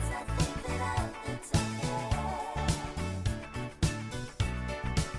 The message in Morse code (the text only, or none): none